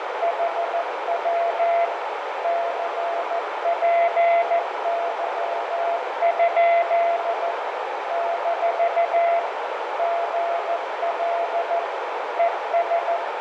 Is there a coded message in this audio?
Yes: Morse code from 0.2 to 13.2 s, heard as a keyed tone, machine-sent, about 14 wpm, 680 Hz, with heavy radio static, fading and a narrow filter. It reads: HW CPY? - GL ES